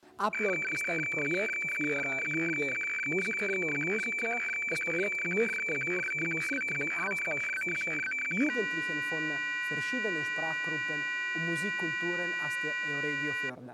Weather fax (radiofax), 120 lines a minute, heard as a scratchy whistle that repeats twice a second.